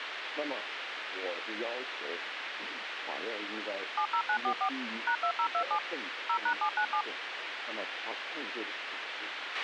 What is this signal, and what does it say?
DTMF, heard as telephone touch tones, dialled by machine, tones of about 80 ms, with radio hiss and a squelch burst at the end. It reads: 70944 #2027 0#797